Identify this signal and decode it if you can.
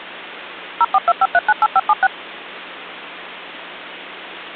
DTMF, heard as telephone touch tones, dialled by machine, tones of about 40 ms. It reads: 0425398576